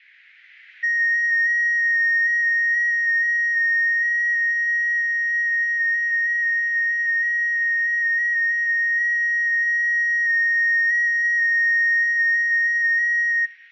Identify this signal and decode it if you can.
FT8 (one signal), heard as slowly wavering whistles, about 6.25 baud.